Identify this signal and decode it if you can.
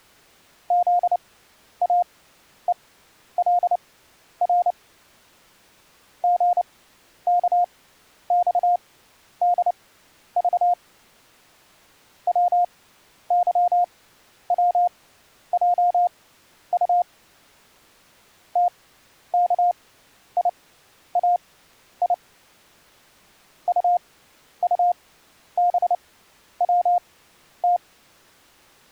Morse code, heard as a keyed tone, machine-sent, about 29 wpm, spaced as for 11 wpm, 710 Hz. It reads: ZAELR GKXDV WYWJU TKIAI UUBWT